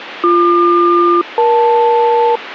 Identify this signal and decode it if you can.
Aircraft SELCAL, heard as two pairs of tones, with radio static. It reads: BQ-EL